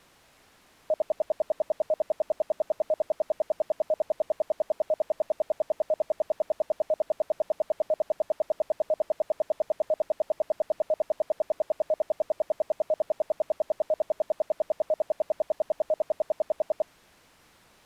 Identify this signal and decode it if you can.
Radio time signal (RWM, Moscow), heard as ten pulses a second.